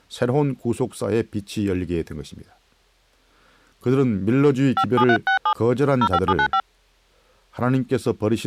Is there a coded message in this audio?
Yes: DTMF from 4.8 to 6.6 s, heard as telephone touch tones, dialled by hand, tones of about 70 ms, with speech in Korean. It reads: 57367 05795